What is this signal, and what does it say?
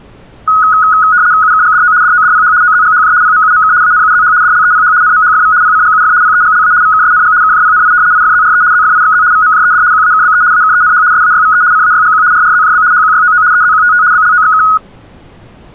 RTTY (75 baud, 170 Hz shift), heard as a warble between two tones, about 1360 Hz centre. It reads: UKGDO DODPH OZGHJ PMUMK ANUZH DLEPH NMHFV PCGUF PEGLA VKSNG KJPNI IFZRE ZFIXZ VMJED QAKBE AKENH SAYVE CAYGQ RRZJB HQYOO EZQTT BLOXK